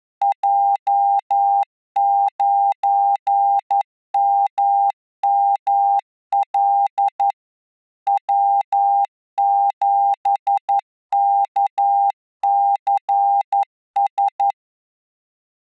Morse code, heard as a keyed tone, machine-sent, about 11 wpm, 800 Hz. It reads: J9MML W7KCS